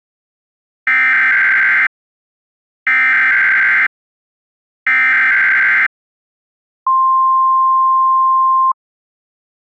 Emergency Alert System (SAME) tones (header bursts, then the 1050 Hz attention tone), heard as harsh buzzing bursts, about 520.83 baud.